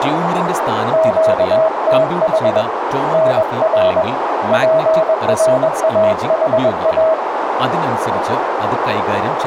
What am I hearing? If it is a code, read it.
Morse code, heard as a keyed tone, hand-sent with a paddle, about 21 wpm, 640 Hz, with radio static, a narrow filter and speech in Malayalam. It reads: QTH NR PRAHA